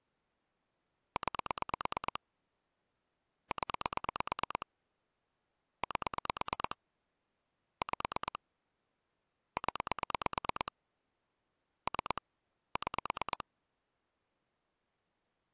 Pulse dialling, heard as clicks on a phone line, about 9 pulses a second. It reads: 9 0 8 5 0 3 6